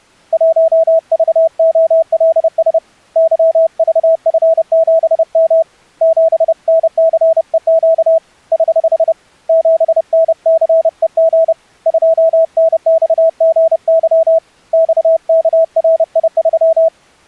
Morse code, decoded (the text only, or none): 1VOLS YVF7M 7NCEQ <HH> 7NCEG 2NXGY XKRI3